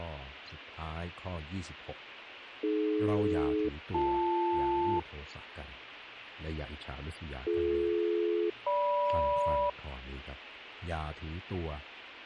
Aircraft SELCAL, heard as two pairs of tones. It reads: AD-BL BD-GM